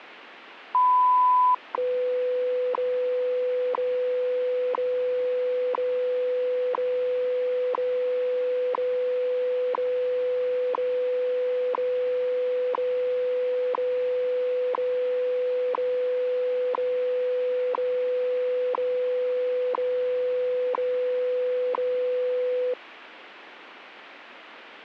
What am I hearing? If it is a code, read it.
Radio time signal (WWV, Colorado), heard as ticks, one a second, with radio static.